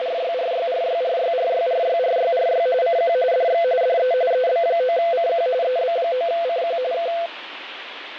RTTY (45.45 baud, 170 Hz shift), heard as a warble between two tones, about 590 Hz centre, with radio static and fading. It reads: … CQ DX DE EB9CQ EB9CQ K